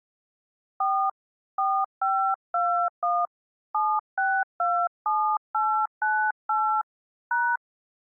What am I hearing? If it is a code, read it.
DTMF, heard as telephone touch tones, dialled by hand, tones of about 280 ms. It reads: 4 4521 7627898 #